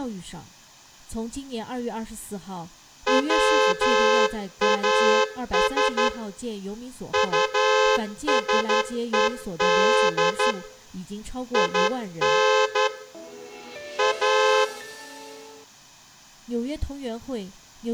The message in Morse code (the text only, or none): WAS USED IN A